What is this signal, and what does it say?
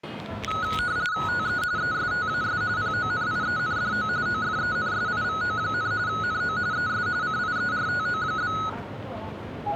RTTY (45.45 baud, 170 Hz shift), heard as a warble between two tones, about 1370 Hz centre, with the noise of a subway station. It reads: TE ESTAS PONIENDO OFENSIVO, NO ES CIERTO?